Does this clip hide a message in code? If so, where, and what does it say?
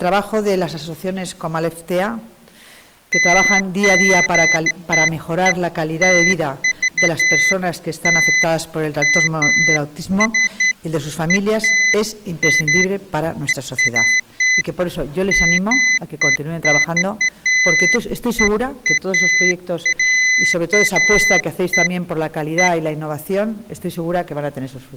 No, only beeps of irregular length.